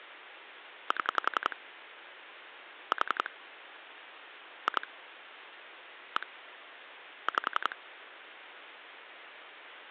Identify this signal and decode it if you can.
Pulse dialling, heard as clicks on a phone line, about 11 pulses a second. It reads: 7 4 2 1 5